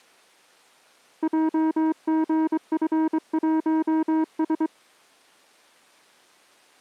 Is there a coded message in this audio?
Yes: Morse code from 1.2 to 4.7 s, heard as a keyed tone, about 23 wpm, 320 Hz. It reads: JGF1S